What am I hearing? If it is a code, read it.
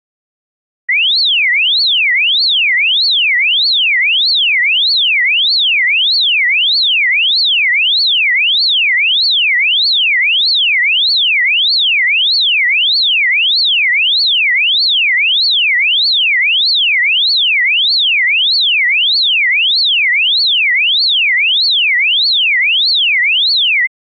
A tone that sweeps in pitch again and again. There is no code.